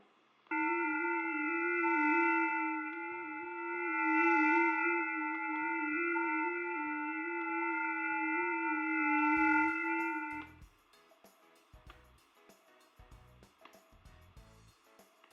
FT8 (several signals at once), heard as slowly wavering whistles, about 6.25 baud, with fading, static crashes and room echo.